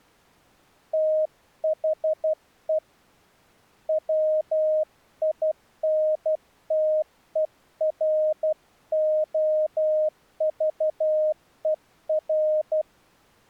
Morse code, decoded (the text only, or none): THE WINTEROVER